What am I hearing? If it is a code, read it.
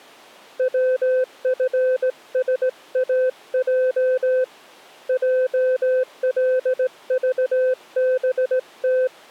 Morse code, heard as a keyed tone, hand-sent with a straight key, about 18 wpm, 510 Hz. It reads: WFSAJ JLVBT